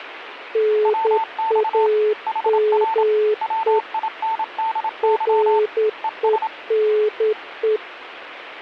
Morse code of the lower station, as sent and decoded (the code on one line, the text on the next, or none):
-. .- -- . / .-. . -. .
NAME RENE